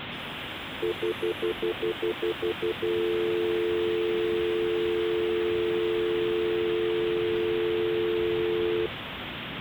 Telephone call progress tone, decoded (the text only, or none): stutter dial tone